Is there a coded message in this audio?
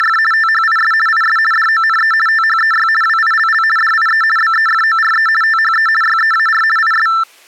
Yes: RTTY (50 baud, 450 Hz shift) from 0.0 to 7.2 s, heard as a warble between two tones, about 1550 Hz centre. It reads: … THIS IS DONE THEY WILL DIE BEFORE THE YEAR IS